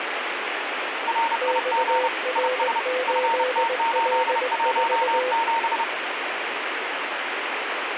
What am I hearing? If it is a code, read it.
Morse code, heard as two keyed tones, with radio static. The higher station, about 30 wpm, 920 Hz: RIG IS FT817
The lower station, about 20 wpm, 510 Hz: XR8L4